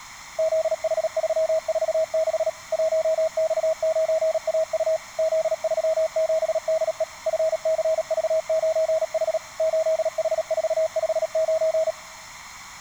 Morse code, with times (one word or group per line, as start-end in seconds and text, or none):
0.4-2.5 ZH346
2.7-5.0 1X9AU
5.2-7.0 Z37DE
7.3-9.4 FCV9H
9.6-11.9 8H459